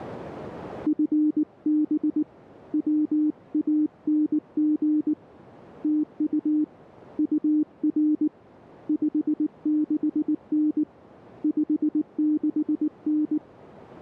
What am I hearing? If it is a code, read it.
Morse code, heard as a keyed tone, hand-sent with a paddle, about 19 wpm, 300 Hz. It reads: FB WANG TU UR 56N 56N